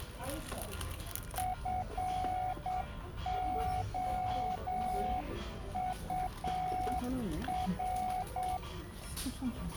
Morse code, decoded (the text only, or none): FOUR